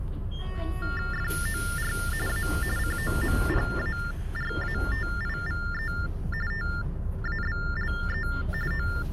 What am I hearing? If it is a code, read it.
TTY/TDD text telephone tones (45.45 baud Baudot), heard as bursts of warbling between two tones, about 400 Hz shift, 1600 Hz centre, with the noise inside a bus. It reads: FOR A COMPARATIVE TABLE …